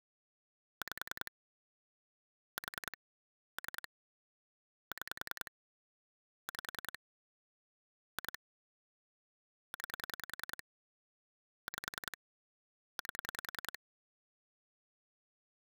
Pulse dialling, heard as clicks on a phone line, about 10 pulses a second. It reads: 5 4 3 6 5 2 9 5 8